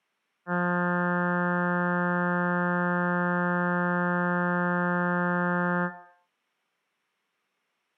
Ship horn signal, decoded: 1 long

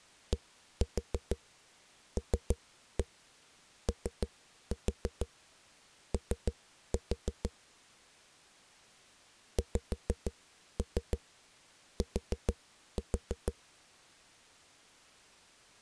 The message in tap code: DLOO XT

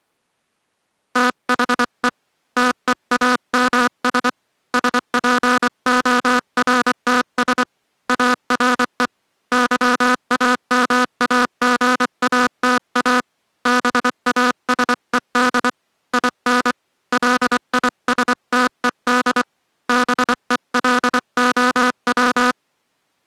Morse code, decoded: THE TEAMS SPORTS ARE YAMAGATA BASED IN LISTED BELOW

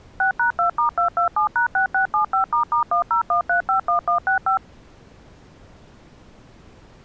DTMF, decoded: 6#2*227#6675**101351165

